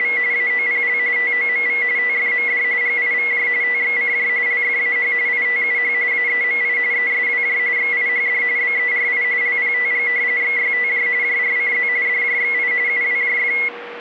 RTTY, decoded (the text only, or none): … AOPL TOMV TFMD GIVJ TXCJ LFAH ITUH AEMI ESWJ XIHD BERI LPTG XYTJ JRCZ DJXI UWJF